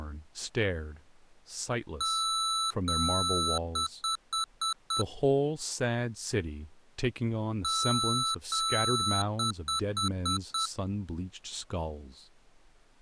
Beep code, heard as beeps from a small speaker, played twice, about 1320 Hz, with speech in English. 2 long, 5 short.